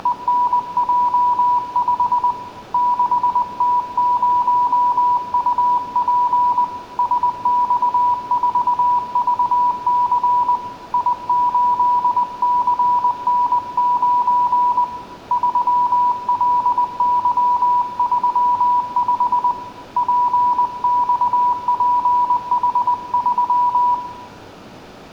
Morse code, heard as a keyed tone, hand-sent with a paddle, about 20 wpm, 980 Hz, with room echo. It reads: … 6T0UP SX4VC I8CN9 3LY35 PXPH3